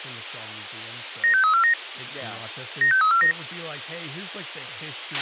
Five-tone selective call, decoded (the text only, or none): 96349 96349